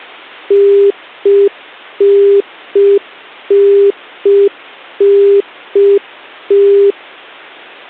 Telephone call progress tone (UK plan), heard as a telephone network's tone, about 400 Hz. Congestion tone.